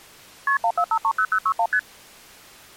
Multi-frequency trunk signalling (R1, as on North American trunks), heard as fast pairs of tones, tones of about 70 ms. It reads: KP 14530061 ST